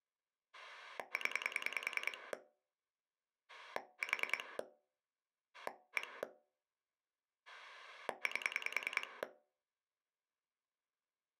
Pulse dialling, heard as a rotary dial, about 10 pulses a second. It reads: 0 4 1 8